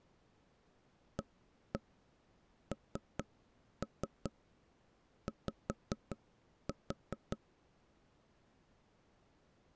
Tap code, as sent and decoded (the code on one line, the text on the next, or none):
1-1 3-3 5-4
ANY